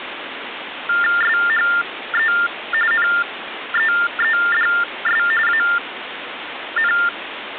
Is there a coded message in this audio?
Yes: TTY/TDD text telephone tones (45.45 baud Baudot) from 0.9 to 7.1 s, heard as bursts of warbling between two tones, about 400 Hz shift, 1600 Hz centre, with phone line noise. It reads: SHE NEEDS AN